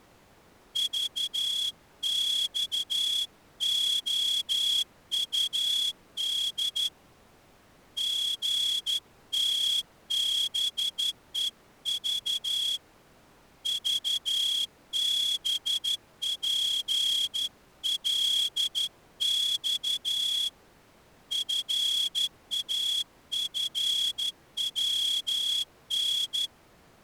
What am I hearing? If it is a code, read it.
Morse code, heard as a whistle, hand-sent with a straight key, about 12 wpm. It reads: VXOUD GTBEV VBPLX FAFWN